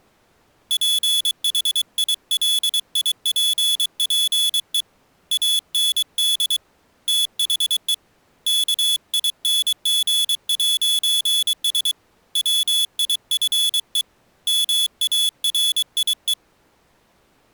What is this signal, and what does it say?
Morse code, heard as a high beeper, hand-sent with a paddle, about 23 wpm, 3400 Hz. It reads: PHILIPPE AND THE KING'S WIFE MARIE